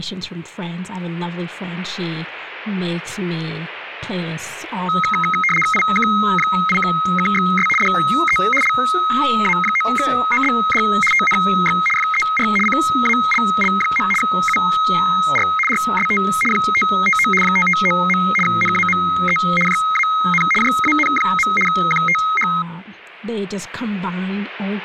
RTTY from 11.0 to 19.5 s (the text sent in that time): TNX FER CALL. UR RST 559 559. NAME